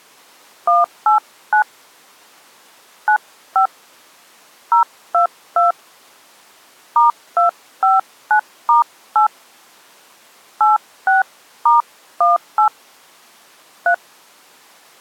DTMF, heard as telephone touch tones, dialled by hand, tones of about 130 ms. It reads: 189 95 022 *259*8 86*18 3